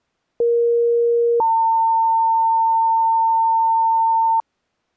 Two-tone page, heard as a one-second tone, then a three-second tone, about 470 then 900 Hz.